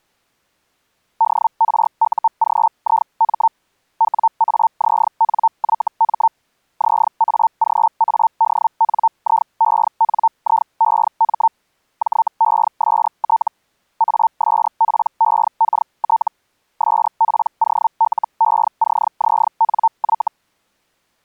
Hellschreiber (Feld-Hell, 122.5 baud), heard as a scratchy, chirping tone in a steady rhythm, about 900 Hz. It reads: DRUGIM WAZNYM ZAGADNIENIEM JEST ASPEKT SPOLECZNY